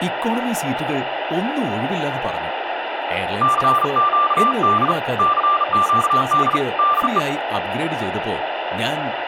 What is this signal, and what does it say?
Morse code, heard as a keyed tone, hand-sent with a bug key, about 37 wpm, 1180 Hz, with speech in Malayalam. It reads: CQD CQD DE